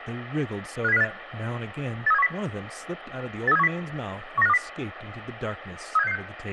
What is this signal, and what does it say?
Five-tone selective call (EEA), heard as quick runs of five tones, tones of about 40 ms, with radio hiss and speech in English. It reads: 57058 83710 83710 19520 37666